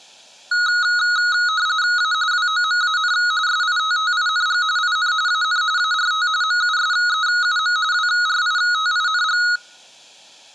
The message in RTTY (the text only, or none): A WOMAN SITTING IN AN ART MUSEUM WRITING